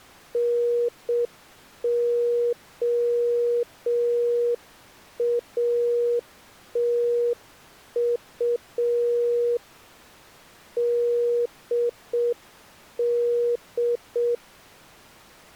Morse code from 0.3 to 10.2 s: NOATU

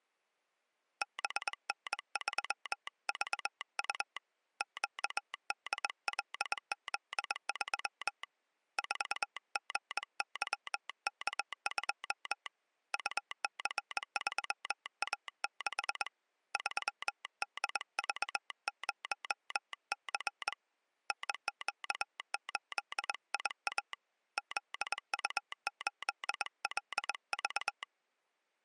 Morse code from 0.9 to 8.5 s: BN3VU QDLZ3

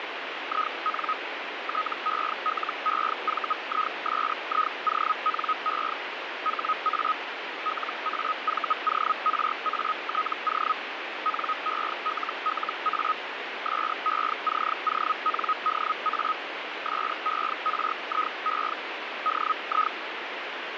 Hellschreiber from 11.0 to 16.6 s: NELLA SECONDA

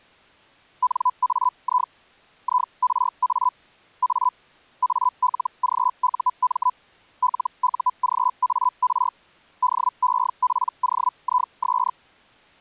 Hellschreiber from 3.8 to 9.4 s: A ALGUM LUGAR

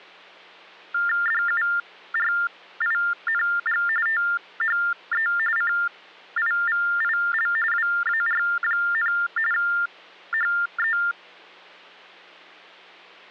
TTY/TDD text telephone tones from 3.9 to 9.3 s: THE CIVIL WAR,

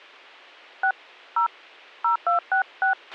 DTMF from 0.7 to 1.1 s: 6

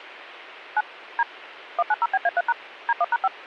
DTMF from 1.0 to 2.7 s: D 190BA3#

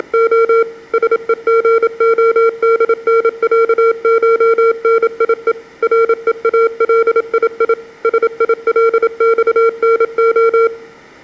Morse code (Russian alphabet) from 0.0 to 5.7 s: … СЕГОДНЯШНИЕ

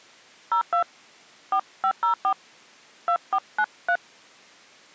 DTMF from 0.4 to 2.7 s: 02 4504

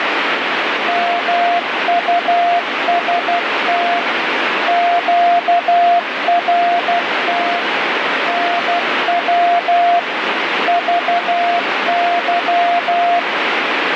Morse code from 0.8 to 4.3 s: MUST

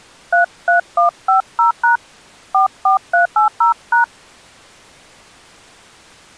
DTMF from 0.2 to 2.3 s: 33150#

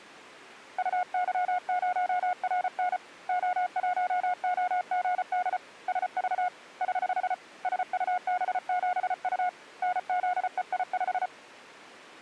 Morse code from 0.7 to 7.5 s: UY0RN O1OGD SV <HH>

